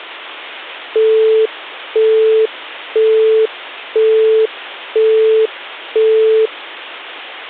Telephone call progress tone (single-tone plan, as in Europe, Japan and elsewhere), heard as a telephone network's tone, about 440 Hz, 0.5 s on and 0.5 s off. Busy tone.